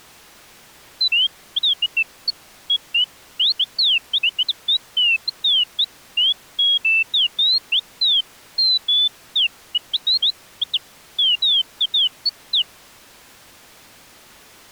Bird-like chirps. There is no code.